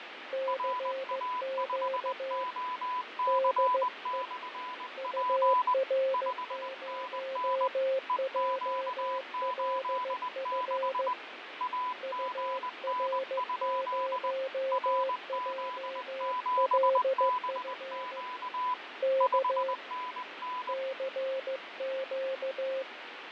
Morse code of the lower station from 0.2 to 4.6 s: CQ DE

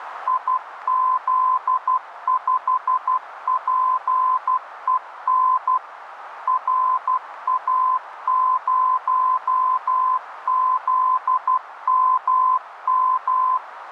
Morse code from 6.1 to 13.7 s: RA0ZMM

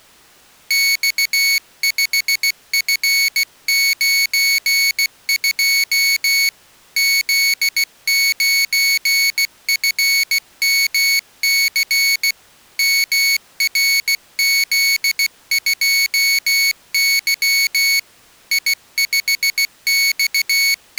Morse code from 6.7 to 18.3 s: Z9FMC MRZ2Y

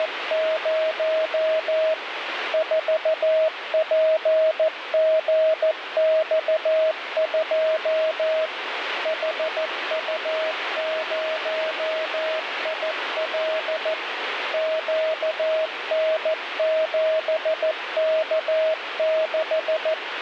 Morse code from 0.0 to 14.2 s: … 4PGX2 HU0IL

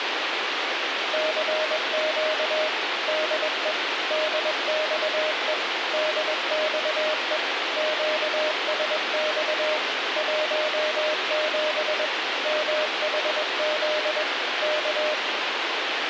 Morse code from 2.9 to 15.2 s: DE DXE DXE QSX 17 MHZ K

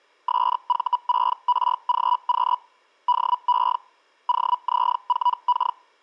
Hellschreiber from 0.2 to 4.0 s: SV6RGQ DE

